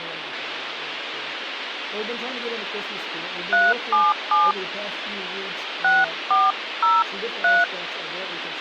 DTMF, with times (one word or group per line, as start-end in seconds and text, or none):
3.5-4.5 377
5.8-7.6 6403